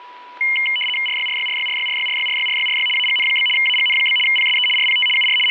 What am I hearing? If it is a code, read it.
RTTY (75 baud, 850 Hz shift), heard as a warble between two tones, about 2550 Hz centre, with static crashes and a steady whistle near 980 Hz. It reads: RYRYRYRYRYRYRYRYRY AGN? AGN? PSE RPT UR …